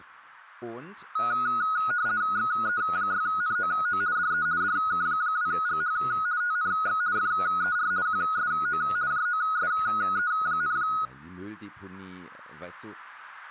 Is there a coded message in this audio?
Yes: RTTY (50 baud, 170 Hz shift) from 1.2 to 11.1 s, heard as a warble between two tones, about 1360 Hz centre, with speech in German. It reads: XE6NOO DE DK2GH TNX FER QSO JOSE,